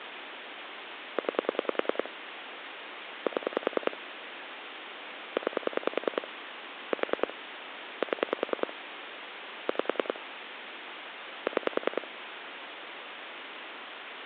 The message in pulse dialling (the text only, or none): 9 7 9 4 7 5 6